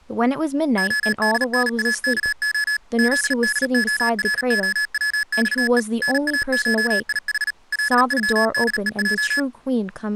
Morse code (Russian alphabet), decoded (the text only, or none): ОДНАКО ЗДОРОВЬЕ НАШИХ ЛЮДЕЙ